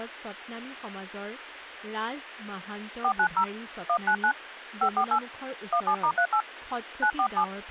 DTMF, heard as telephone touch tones, dialled by hand, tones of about 80 ms, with speech in Assamese. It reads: 490 199 548 17*38 947